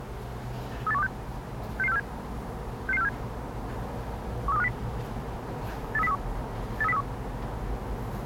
Five-tone selective call (EEA), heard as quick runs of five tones, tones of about 40 ms, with the noise inside a lift. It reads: 38126 66647 66647 13250 83031 83031